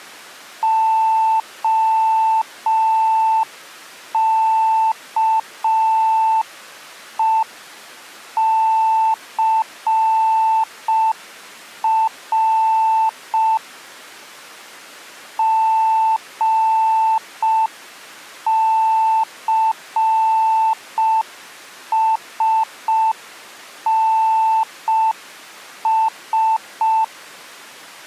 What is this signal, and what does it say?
Morse code, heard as a keyed tone, hand-sent with a paddle, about 5 wpm, 890 Hz. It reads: OKECR GCSNS